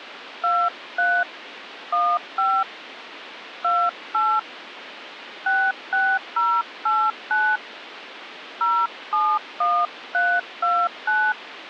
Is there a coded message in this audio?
Yes: DTMF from 0.4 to 11.3 s, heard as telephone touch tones, dialled by hand, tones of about 250 ms, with phone line noise. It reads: 23 15 28 66089 071329